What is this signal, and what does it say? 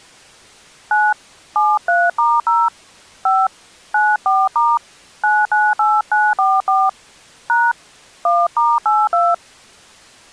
DTMF, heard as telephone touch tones, dialled by hand, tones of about 220 ms. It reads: 9 73*0 5 94* 998944 # 1*82